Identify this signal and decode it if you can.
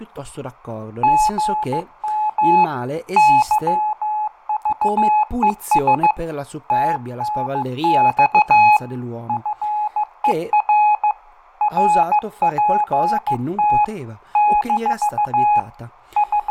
Morse code, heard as a keyed tone, hand-sent with a paddle, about 15 wpm, 840 Hz, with fading, room echo and speech in Italian. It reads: GM YVES TNX FER RPT - …